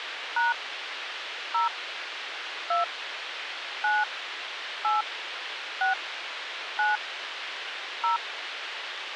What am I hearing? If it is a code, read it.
DTMF, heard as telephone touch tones, dialled by hand, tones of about 160 ms, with radio hiss. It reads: # 0 2 9 8 6 9 0